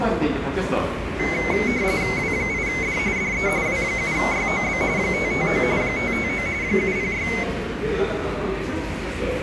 RTTY (45.45 baud, 170 Hz shift), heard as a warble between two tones, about 2150 Hz centre, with the noise of a crowd indoors. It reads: W8D DE W7YOB 559 559 706